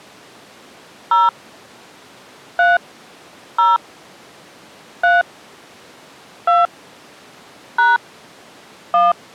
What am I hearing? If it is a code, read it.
DTMF, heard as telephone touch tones, dialled by hand, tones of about 180 ms. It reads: 0 3 0 3 2 # 1